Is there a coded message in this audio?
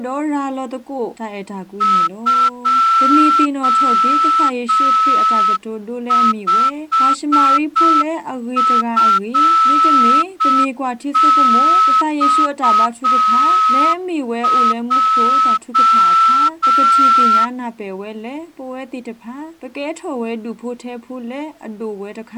Yes: Morse code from 1.8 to 17.5 s, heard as a whistle, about 6 wpm. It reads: 25FXJ